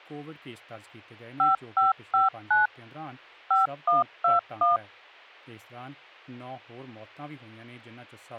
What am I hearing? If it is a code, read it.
DTMF, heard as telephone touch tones, dialled by machine, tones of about 150 ms, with a squelch burst at the end. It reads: 5559 5121